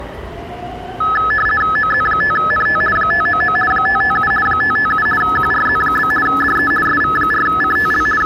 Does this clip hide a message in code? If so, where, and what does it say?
Yes: RTTY (50 baud, 450 Hz shift) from 1.0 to 8.3 s, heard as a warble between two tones, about 1500 Hz centre, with the noise of a subway station. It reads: OZ5NT 599 557 557 QRZ? DE SV4CTL …